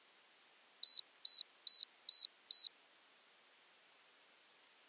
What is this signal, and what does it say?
Beep code, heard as a piezo beeper, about 4050 Hz. 5 short. In AMI BIOS tables: processor failure; in Dell tables: CMOS battery failure.